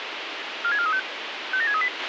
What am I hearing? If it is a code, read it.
Five-tone selective call (ZVEI), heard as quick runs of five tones, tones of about 70 ms, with radio hiss and a squelch burst at the end. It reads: 46435 57638